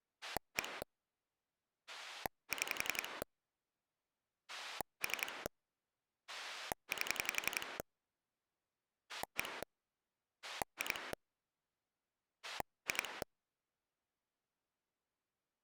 Pulse dialling, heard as a rotary dial, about 11 pulses a second. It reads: 1 6 3 8 1 2 2